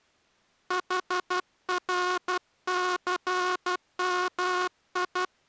Morse code, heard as a buzzer, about 12 wpm. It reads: HRCMI